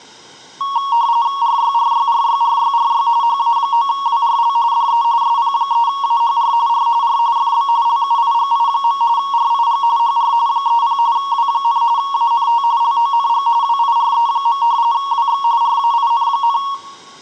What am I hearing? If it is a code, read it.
RTTY (45.45 baud, 170 Hz shift), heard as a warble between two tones, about 1020 Hz centre, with room echo. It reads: RYRYRYRYRY HA9WRL DE SP3AHR R R FB LUIGI. RIG HR 30 W, ANT LONG WIRE. WX RAIN,